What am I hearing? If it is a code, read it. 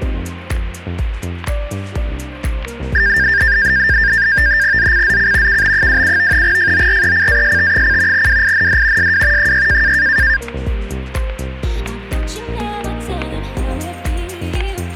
NAVTEX (SITOR-B), 100 baud, 170 Hz shift, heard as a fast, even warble, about 1700 Hz centre, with static crashes. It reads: ZCZC KB27 FORECAST: WIND SW 6